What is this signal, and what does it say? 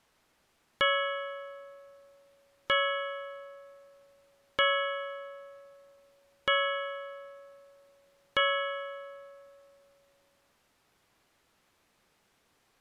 Clock strike, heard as a bell. 5. Five o'clock.